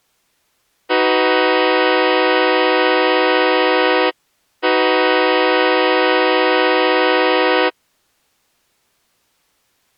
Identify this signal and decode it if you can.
Train horn signal, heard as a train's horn. 2 long. On North American railways: brakes released, proceed.